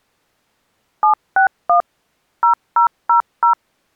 DTMF, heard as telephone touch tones, dialled by machine, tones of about 110 ms. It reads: 761 0000